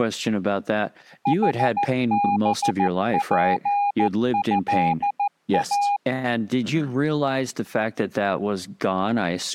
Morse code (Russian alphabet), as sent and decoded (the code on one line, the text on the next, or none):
.... -... .--. ..-.. .-
ХБПЭА